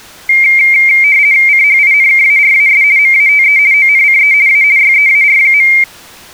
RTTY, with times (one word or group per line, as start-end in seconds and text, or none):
1.5-2.8 CHINKARAS
3.0-3.6 MATE
3.7-4.3 ONCE
4.5-4.6 A
4.8-5.7 YEAR.